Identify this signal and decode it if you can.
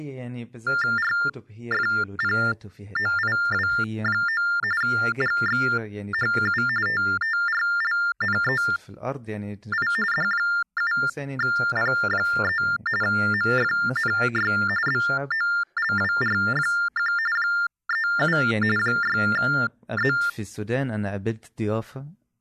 TTY/TDD text telephone tones (45.45 baud Baudot), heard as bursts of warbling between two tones, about 400 Hz shift, 1600 Hz centre, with speech in Arabic. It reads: RFPOIW9 GXHU TTRLNEI D7P3 MFNY BOLWR1 37 6Z